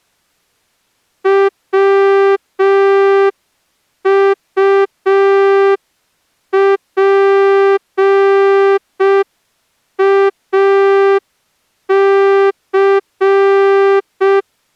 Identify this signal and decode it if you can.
Morse code, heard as a horn, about 5 wpm. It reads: WUPAC